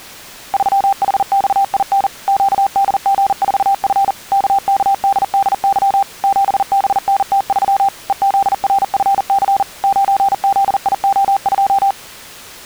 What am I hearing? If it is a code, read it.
Morse code, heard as a keyed tone, machine-sent, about 40 wpm, 790 Hz. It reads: 3HXIN QDG4F KKDDY 7BNT3 EZRFC 9ZIO2